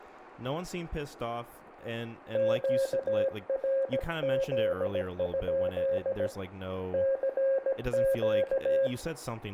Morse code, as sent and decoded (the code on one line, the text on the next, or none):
--.- .-. --.. ..--.. / -.-. --.-
QRZ? CQ